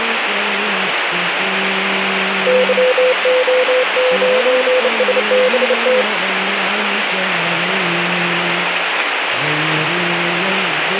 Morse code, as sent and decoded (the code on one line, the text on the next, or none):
-.-- --- ----. ... -... -
YO9SBT